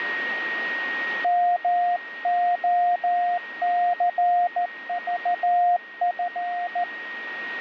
Morse code, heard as a keyed tone, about 14 wpm, 710 Hz, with radio static and a steady whistle near 1870 Hz. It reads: MOCVF